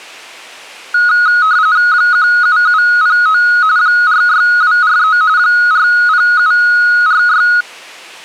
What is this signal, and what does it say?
RTTY (45.45 baud, 170 Hz shift), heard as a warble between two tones, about 1360 Hz centre. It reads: 17709 46243 40746